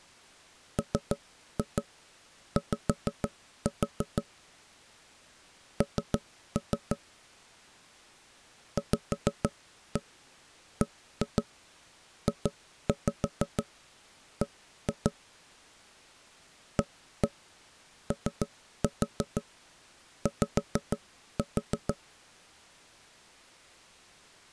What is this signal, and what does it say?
Tap code, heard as knocks on wood, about 6 knocks a second. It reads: MY N VBJB AOY